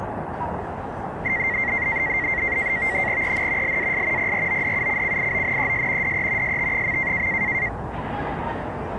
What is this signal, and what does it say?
NAVTEX (SITOR-B), 100 baud, 170 Hz shift, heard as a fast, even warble, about 2000 Hz centre, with the noise of a residential street. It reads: EN LAS PRODUCCIONES DE ST.